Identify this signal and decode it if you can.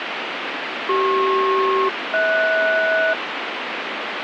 Aircraft SELCAL, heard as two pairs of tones, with radio static. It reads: CP-HS